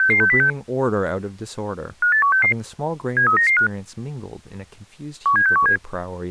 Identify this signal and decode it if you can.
Five-tone selective call (CCIR), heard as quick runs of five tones, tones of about 100 ms, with speech in English. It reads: 66606 58166 73995 17617